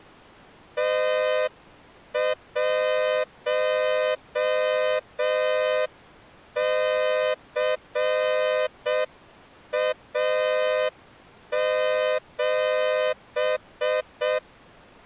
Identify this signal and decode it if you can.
Morse code, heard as a horn, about 6 wpm. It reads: T1CA7